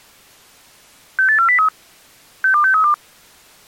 Five-tone selective call (CCIR), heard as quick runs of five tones, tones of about 100 ms. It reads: 68403 62632